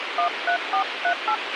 DTMF, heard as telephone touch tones, dialled by hand, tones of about 90 ms, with radio hiss and a squelch burst at the end. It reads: 13438